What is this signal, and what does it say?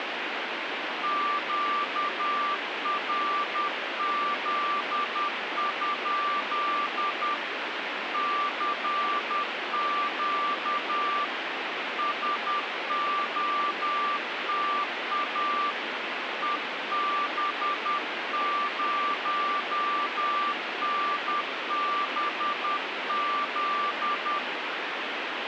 Morse code, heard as a keyed tone, hand-sent with a paddle, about 10 wpm, 1170 Hz, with radio static. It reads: QRZ? CQ SOTA EB0NBZ